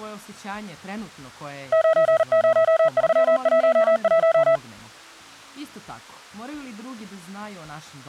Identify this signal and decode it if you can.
Morse code, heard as a keyed tone, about 39 wpm, 650 Hz. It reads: 90311